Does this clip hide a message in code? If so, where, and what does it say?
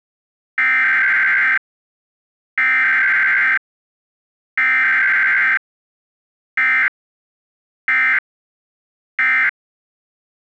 Yes: Emergency Alert System (SAME) tones (header bursts, then end-of-message bursts) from 0.6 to 9.5 s, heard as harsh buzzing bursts, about 520.83 baud.